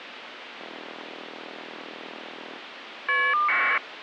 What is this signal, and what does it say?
Caller ID data burst, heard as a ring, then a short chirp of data, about 1200 baud, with phone line noise.